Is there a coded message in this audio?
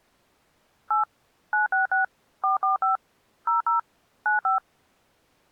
Yes: DTMF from 0.9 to 4.6 s, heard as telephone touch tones, dialled by machine, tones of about 130 ms. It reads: 8 966 445 00 95